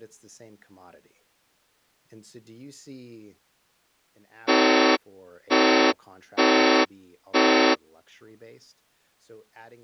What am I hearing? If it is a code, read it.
Train horn signal, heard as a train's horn, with speech in English. 4 short. On North American railways: a request for a signal to be given or repeated.